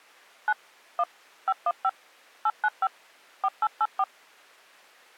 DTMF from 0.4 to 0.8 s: 9

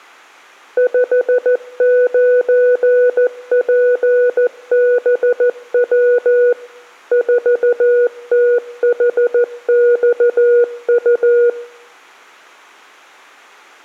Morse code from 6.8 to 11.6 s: 4THXU

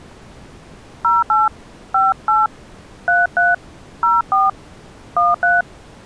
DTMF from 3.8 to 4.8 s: 04

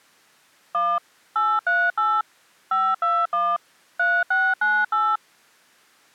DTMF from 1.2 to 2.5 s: 838

